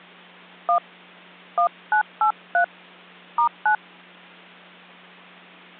DTMF, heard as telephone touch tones, dialled by hand, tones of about 100 ms, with hum. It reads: 1 1983 *9